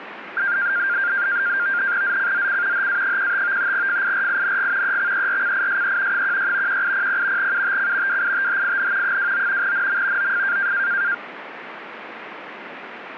NAVTEX (SITOR-B), 100 baud, 170 Hz shift, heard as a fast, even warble, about 1500 Hz centre, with radio static. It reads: ZCZC HA15 FIRING EXERCISE 16 1800 UTC WITHIN 29 NM OF